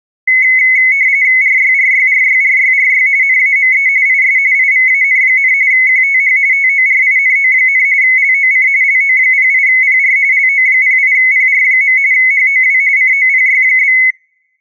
RTTY (45.45 baud, 170 Hz shift), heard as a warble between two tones, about 2100 Hz centre. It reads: RYRYRYRYRY NAME IS IVAN, QTH TORINO, LOC LO08PR LO08PR. HOW COPY?